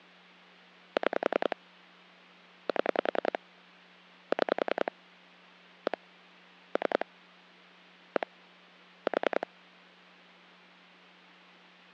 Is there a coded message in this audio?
Yes: pulse dialling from 1.0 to 9.4 s, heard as clicks on a phone line, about 10 pulses a second, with hum. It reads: 6 7 6 1 3 1 4